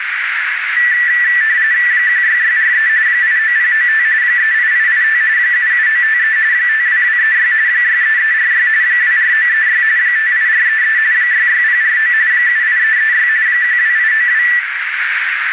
RTTY (45.45 baud, 170 Hz shift), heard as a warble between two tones, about 1850 Hz centre, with radio static and a narrow filter. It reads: 16643 89095 38885 77953 52236 63346 24936 58433 66049 78336 12892